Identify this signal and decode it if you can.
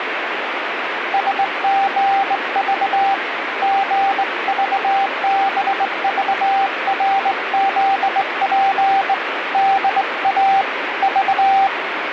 Morse code, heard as a keyed tone, hand-sent with a straight key, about 20 wpm, 780 Hz, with radio static. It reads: SGV GVBVRZP DA V